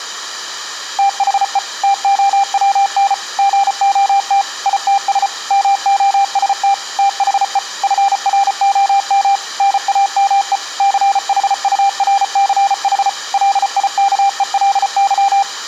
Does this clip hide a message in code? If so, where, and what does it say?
Yes: Morse code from 0.9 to 15.5 s, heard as a keyed tone, machine-sent, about 34 wpm, 790 Hz. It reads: THE TOWN GOT ITS MOST THE FROM NAME CHURCH LIKELY